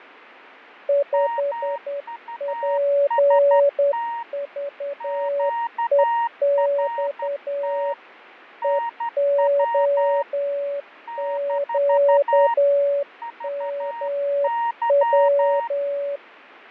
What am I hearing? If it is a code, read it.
Morse code, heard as two keyed tones, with fading. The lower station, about 10 wpm, 570 Hz: 5PVEX EOQMW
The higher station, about 12 wpm, 930 Hz: MUST QRT NW - VY